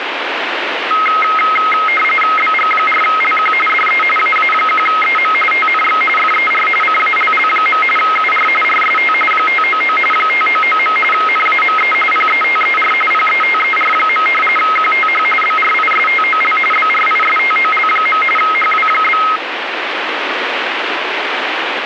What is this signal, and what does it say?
RTTY (45.45 baud, 850 Hz shift), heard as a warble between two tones, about 1700 Hz centre, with radio static. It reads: BG4LQ DE AA1EM TNX FER CALL. UR RST 599 599. NAME PETER PETER. QTH BRISTOL BRISTOL. HW?